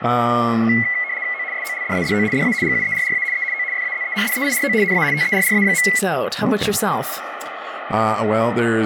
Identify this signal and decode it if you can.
RTTY (75 baud, 170 Hz shift), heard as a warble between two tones, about 2050 Hz centre, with radio static and speech in English. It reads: O SOLDADO DA GUERRA E O FAZENDEIRO NA TERRA.